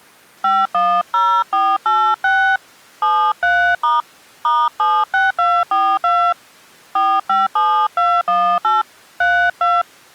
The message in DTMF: 510486 73* *76242 457218 32

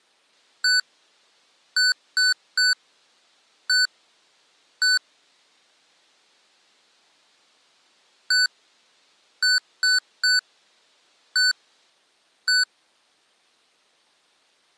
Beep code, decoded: 1-3-1-1

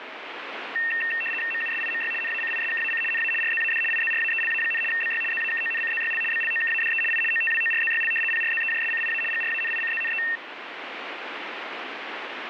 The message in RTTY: MUSIMY NACISKAC NA RZAD IZRAELA, BY ZAKONCZYL BLOKADE I OTWORZYL PRZEJSCIA GRANICZNE

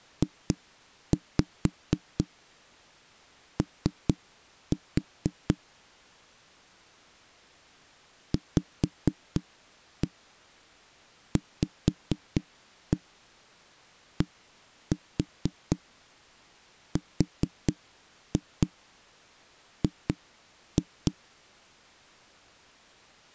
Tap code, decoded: JO VVDRG

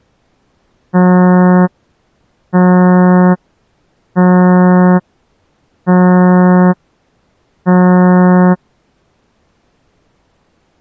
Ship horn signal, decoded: 5 short

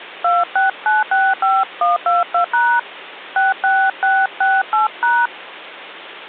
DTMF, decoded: 26965122# 66668#

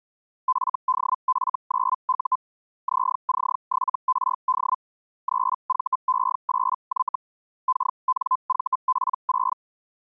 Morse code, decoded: none

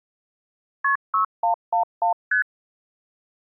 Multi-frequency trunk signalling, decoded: KP 6111 ST

